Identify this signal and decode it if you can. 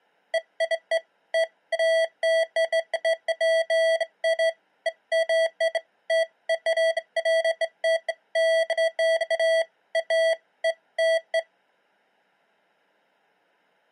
Beeps of irregular length. There is no code.